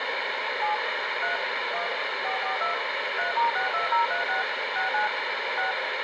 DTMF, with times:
0.6-0.7 7
1.2-1.4 3
1.7-1.9 1
2.2-2.7 442
3.2-4.4 3*62036
4.8-5.1 69
5.6-5.7 6

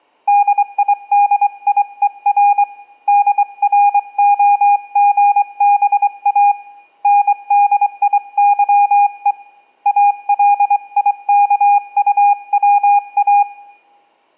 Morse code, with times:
0.3-2.6 DIDIER
3.1-6.5 DROGBA
7.0-9.3 NDIYE
9.9-13.4 ALIKUWA

